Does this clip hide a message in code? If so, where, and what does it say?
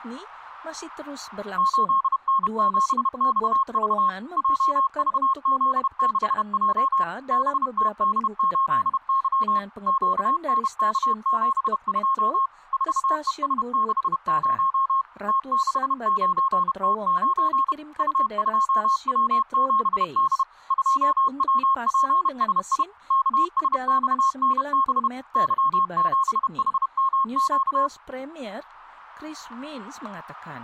Yes: Morse code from 1.5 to 27.9 s, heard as a keyed tone, machine-sent, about 31 wpm, 1080 Hz. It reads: 8N7XV JVZ6J BTD8Y QNK72 4ES60 T69T9 U2W7D 2WPSI KSXNB Y7HMQ